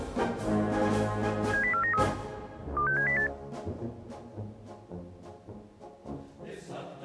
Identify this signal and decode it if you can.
Five-tone selective call (CCIR), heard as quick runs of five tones, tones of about 100 ms. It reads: 70493 26708